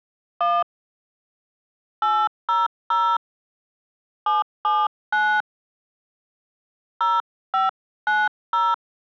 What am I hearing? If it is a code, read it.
DTMF, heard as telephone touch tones, dialled by hand, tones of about 220 ms. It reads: 1 800 779 0590